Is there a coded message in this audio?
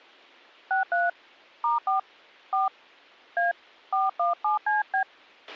Yes: DTMF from 0.7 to 5.0 s, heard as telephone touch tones, dialled by hand, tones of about 150 ms, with a squelch burst at the end. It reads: 63 *4 4 A 417CB